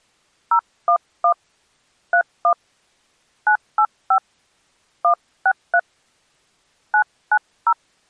DTMF, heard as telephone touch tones, dialled by hand, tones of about 80 ms. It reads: 011 31 985 163 990